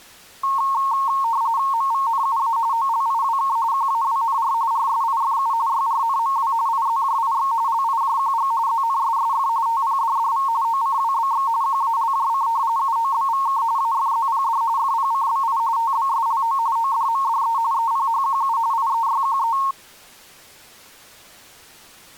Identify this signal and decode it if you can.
RTTY (45.45 baud, 170 Hz shift), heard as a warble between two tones, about 1000 Hz centre. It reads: MVNUA OLIWK QAWNR RSIFU YRNMW IZJIX LIJQG ZNSSF TPDDV OCWBX QALJC UOBVK AFZPD FPCBI TBSLO ODMDE EPHQU IEYQE